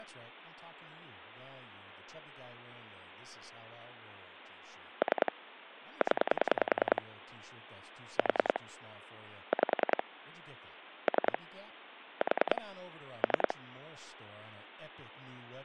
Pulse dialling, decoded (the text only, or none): 3 0 4 5 3 4 3